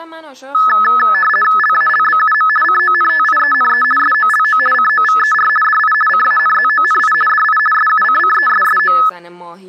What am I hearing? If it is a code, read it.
RTTY (50 baud, 450 Hz shift), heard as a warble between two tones, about 1500 Hz centre, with speech in Persian. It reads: LALBUM CONTIENE SOLO COVER DI CANZONI DI SUCCESSO